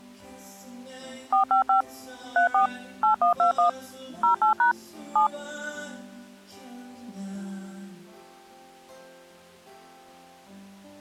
DTMF, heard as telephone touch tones, dialled by machine, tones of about 110 ms. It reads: 455 34 8121 08# 7